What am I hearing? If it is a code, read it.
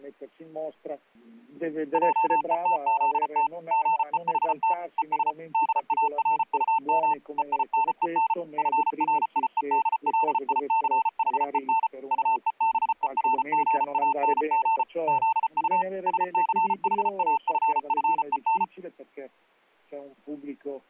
Morse code, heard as a keyed tone, machine-sent, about 34 wpm, 900 Hz. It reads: JETZT GEHT ES DARUM EINEN FRIEDLICHEN UEBERGANG ZU SCHAFFEN